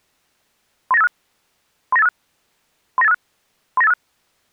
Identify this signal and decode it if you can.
Five-tone selective call (EIA), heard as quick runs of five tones, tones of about 30 ms. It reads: 39856 39856 39856 39856